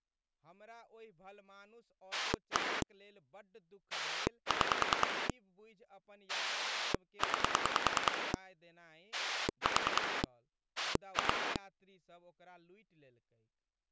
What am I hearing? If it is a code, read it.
Pulse dialling, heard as a rotary dial, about 10 pulses a second, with speech in Maithili. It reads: 1 6 9 4 2